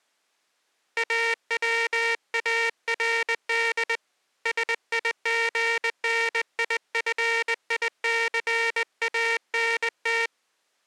Morse code, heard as a buzzer, hand-sent with a straight key, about 20 wpm. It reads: AWARD SIGNIFICANT